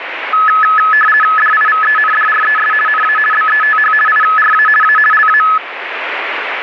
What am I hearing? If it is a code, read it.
RTTY (50 baud, 450 Hz shift), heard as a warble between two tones, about 1500 Hz centre, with radio static. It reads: DIVENDRES NA BETH IRA A LA